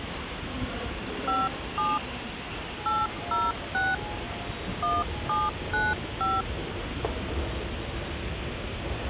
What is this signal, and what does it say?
DTMF, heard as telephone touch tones, dialled by hand, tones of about 200 ms, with phone line noise and the noise of a subway station. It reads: 57 806 1795